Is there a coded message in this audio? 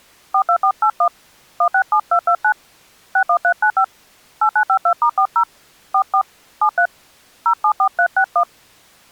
Yes: DTMF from 0.3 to 8.4 s, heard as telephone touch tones, dialled by hand, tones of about 80 ms. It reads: 42481 167229 61395 8952*40 44 73 074361